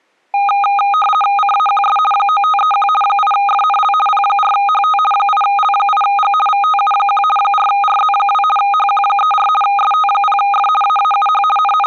RTTY (50 baud, 450 Hz shift), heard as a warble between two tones, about 1030 Hz centre. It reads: CAQS 9531 8FNL P4HT 8L8G VTU1 4RZ2 HQ34 ST0F AAUH …